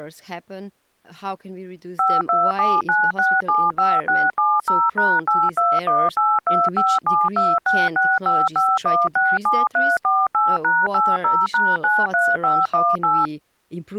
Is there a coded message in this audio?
Yes: DTMF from 2.0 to 13.3 s, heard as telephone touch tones, dialled by machine, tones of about 220 ms, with speech in English. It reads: 5279675670#821825726655167348#80#93518